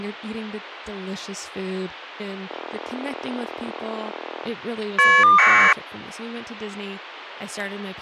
Caller ID data burst, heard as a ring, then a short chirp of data, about 1200 baud, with speech in English.